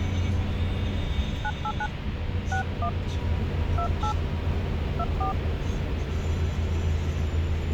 DTMF, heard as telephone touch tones, dialled by hand, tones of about 80 ms, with phone line noise and the noise inside a bus. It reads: 989 61 28 24